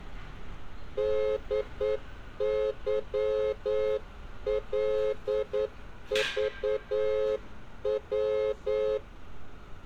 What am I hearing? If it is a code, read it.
Morse code, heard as a horn, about 9 wpm, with street noise. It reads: DYLVW